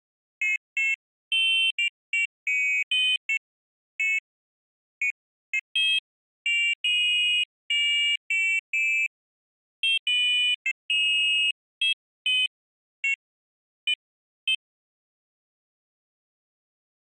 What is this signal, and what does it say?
Pairs of high tones at irregular times. There is no code.